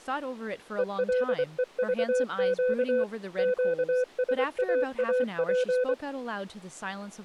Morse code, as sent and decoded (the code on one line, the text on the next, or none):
. .-.. . ...- --.- / --.- ... .- .- .--.
ELEVQ QSAAP